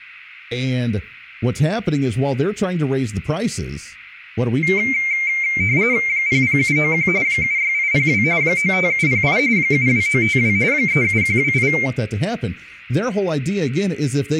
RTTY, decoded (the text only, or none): 00791 76802 95708 72952 37128